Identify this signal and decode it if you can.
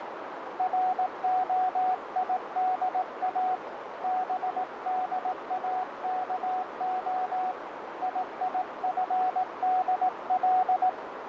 Morse code (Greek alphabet), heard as a keyed tone, hand-sent with a paddle, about 18 wpm, 740 Hz, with radio static and a narrow filter. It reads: ΡΟΙΔΑ ΒΔΑΚΟ ΙΙΦΔΛ